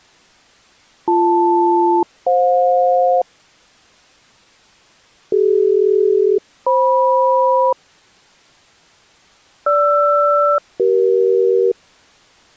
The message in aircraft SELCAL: BL-FJ CD-FM GR-CE

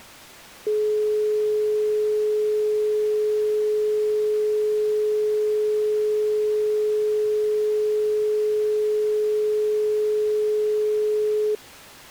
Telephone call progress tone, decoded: dial tone

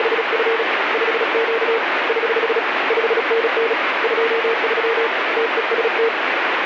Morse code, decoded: … 5Q <HH> 5NN 23 TEST

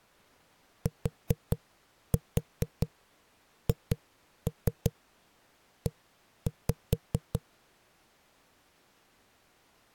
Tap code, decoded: THE

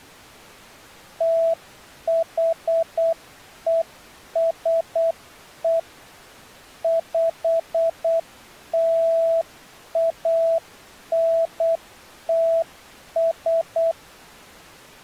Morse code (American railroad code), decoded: THESE PLANTS

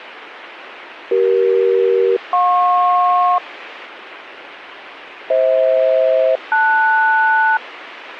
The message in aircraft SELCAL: CE-JP FH-LS

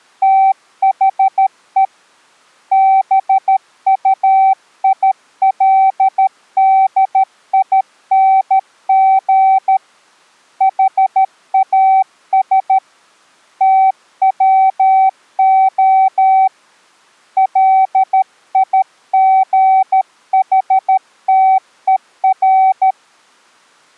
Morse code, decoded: THE BUILDING HAS TWO LIGHTER

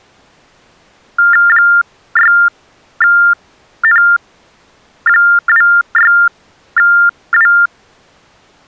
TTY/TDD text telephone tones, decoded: 6N26W

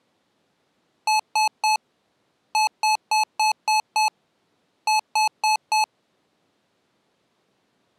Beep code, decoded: 3-6-4

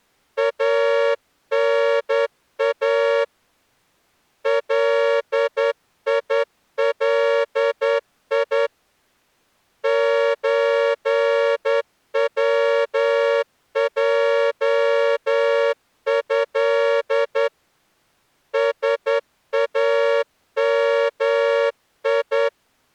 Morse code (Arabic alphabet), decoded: انا ليلي زوجه سامي

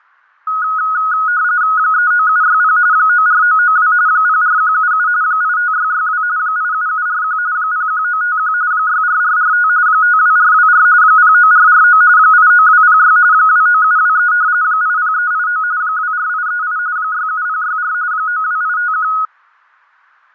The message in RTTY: 39760 94992 04177 85662 87741 01951 64445 52424 09449 89206 29723 80389 24838 67064 92851

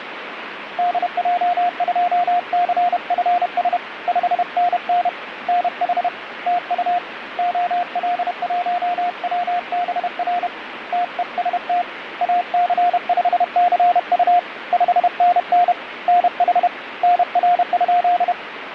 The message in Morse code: DJ2CFS 5NN NH TU OL1WBR TEST AC5CU 5NN NH NR?

